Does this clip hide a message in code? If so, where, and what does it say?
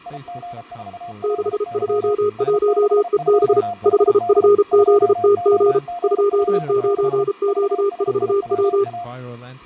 Yes: Morse code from 0.0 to 9.1 s, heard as two keyed tones, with fading and speech in English. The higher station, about 33 wpm, 700 Hz: IG4LY S62HD 2OGP6 VSIWA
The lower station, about 33 wpm, 410 Hz: 621EB 5FZTG 29Q4W